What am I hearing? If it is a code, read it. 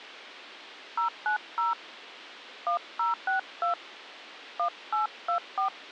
DTMF, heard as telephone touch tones, dialled by hand, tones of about 120 ms. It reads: 090 1062 1824